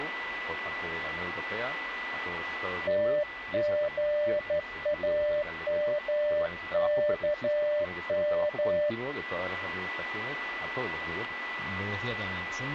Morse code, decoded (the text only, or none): TGAMKM